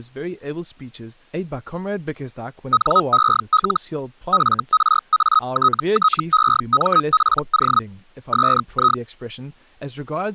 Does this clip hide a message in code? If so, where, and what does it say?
Yes: Hellschreiber (Feld-Hell, 122.5 baud) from 2.7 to 9.0 s, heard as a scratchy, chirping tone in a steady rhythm, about 1270 Hz, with speech in English. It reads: NEL FRATTEMPO SI